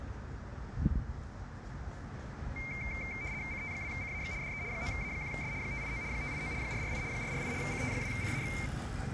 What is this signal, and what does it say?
RTTY (75 baud, 170 Hz shift), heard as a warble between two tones, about 2200 Hz centre, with street noise. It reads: CT2CAX DE 9A1S 589 589 448 448 CT2CAX